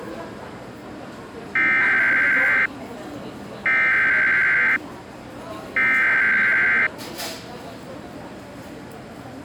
Emergency Alert System (SAME) tones (header bursts), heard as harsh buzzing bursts, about 520.83 baud, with the noise of a crowd indoors.